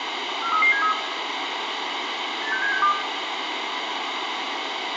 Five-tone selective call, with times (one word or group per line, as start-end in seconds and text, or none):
0.4-0.9 43373
2.4-2.9 86762